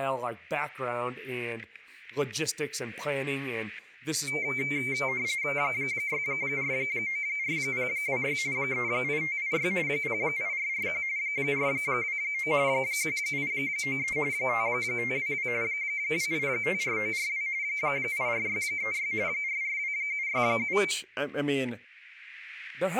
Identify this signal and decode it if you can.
RTTY (45.45 baud, 170 Hz shift), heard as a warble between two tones, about 2200 Hz centre, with static crashes and speech in English. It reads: 6494026 38586 08441 429 1893 5522 2854942 84636 442767